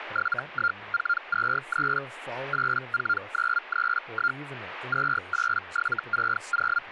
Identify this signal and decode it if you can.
Hellschreiber (Feld-Hell, 122.5 baud), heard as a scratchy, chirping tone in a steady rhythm, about 1400 Hz, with speech in English. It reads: 71423 84931 28760